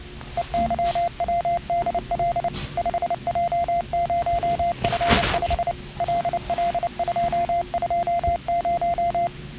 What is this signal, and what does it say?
Morse code, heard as a keyed tone, machine-sent, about 29 wpm, 690 Hz, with the noise inside a lift. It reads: EYWDL 5J0F5 LL220